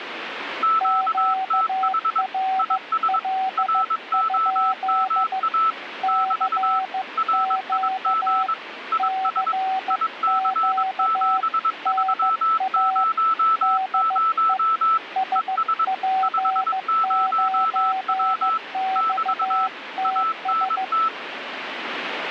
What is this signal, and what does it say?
Morse code, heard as two keyed tones, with radio static. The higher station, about 22 wpm, 1320 Hz: QTH IS ROMA <BT> RIG IS IC7300 ES 50W <BT> ANT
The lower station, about 15 wpm, 760 Hz: QRL? CQ CQ NA DE SP9XTS